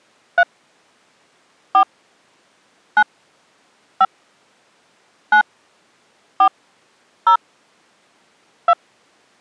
DTMF, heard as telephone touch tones, dialled by hand, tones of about 80 ms. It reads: 3 4 9 5 9 4 0 2